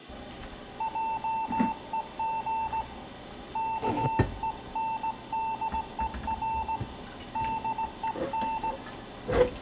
Morse code, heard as a keyed tone, hand-sent with a straight key, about 18 wpm, 890 Hz, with room echo and kitchen noise. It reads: JEG KENDER DEN